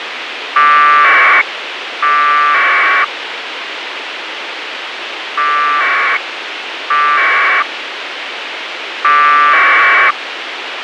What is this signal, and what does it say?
Packet radio (AX.25, as in APRS), 1200 baud, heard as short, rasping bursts, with radio hiss and a squelch burst at the end.